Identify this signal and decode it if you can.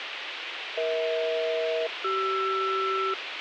Aircraft SELCAL, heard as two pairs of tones, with radio hiss and a squelch burst at the end. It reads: EH-CR